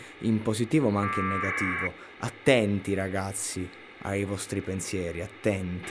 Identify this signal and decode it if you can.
Packet radio (AX.25, as in APRS), 1200 baud, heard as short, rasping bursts, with radio hiss, a squelch burst at the end and speech in Italian.